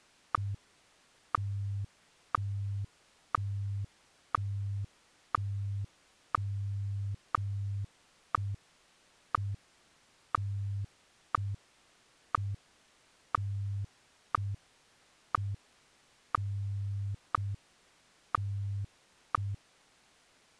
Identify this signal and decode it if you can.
Radio time signal (WWVH, Hawaii), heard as ticks, one a second.